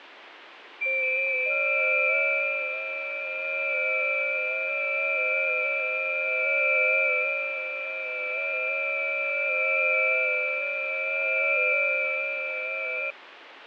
FT8 (several signals at once), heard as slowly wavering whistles, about 6.25 baud, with radio static and fading.